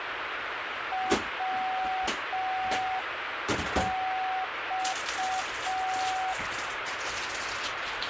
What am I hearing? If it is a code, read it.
Morse code, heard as a keyed tone, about 5 wpm, 750 Hz, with radio static and kitchen noise. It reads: WX